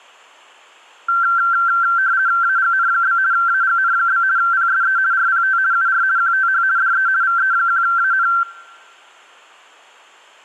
RTTY (50 baud, 170 Hz shift), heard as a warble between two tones, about 1460 Hz centre. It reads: AGN? AGN? PSE RPT UR QTH DE VE1AN